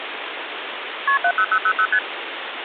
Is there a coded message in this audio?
Yes: multi-frequency trunk signalling (R1, as on North American trunks) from 1.1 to 2.0 s, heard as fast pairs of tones, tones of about 70 ms, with phone line noise. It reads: KP 70000 ST